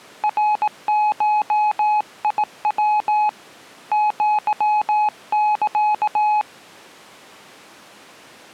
Morse code (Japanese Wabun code), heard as a keyed tone, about 18 wpm, 840 Hz. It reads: ナゴヤ アサ